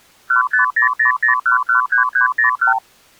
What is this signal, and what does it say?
Multi-frequency trunk signalling (R2, with the far end's replies), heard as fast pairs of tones, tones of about 120 ms. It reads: 15000113301